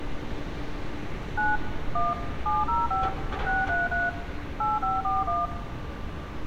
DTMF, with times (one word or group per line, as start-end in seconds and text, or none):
1.4-1.6 9
2.0-2.1 1
2.5-3.1 705
3.5-4.1 633
4.6-5.5 8541